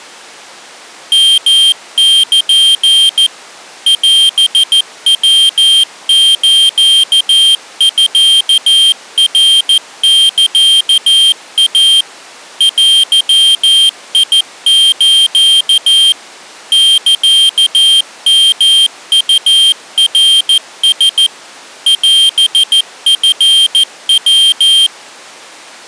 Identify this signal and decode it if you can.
Morse code (Japanese Wabun code), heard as a high beeper, machine-sent, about 14 wpm, 3150 Hz. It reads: ヨル オヤスミナサイ デス サヨウナラ オチヤ